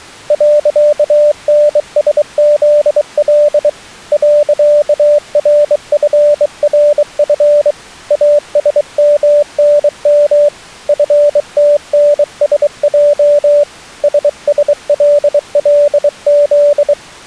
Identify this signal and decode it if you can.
Morse code, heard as a keyed tone, hand-sent with a bug key, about 23 wpm, 590 Hz. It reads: .NSZL .RFRF ASMNM FTNSJ SSLLZ